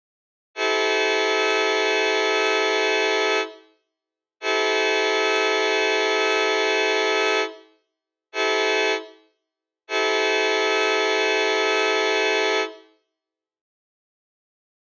Train horn signal, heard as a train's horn, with room echo. 2 long, 1 short, 1 long. On North American railways: approaching a public crossing.